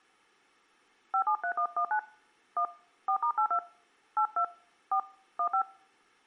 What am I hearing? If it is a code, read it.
DTMF, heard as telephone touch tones, dialled by hand, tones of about 80 ms. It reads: 573119 1 4*82 82 4 15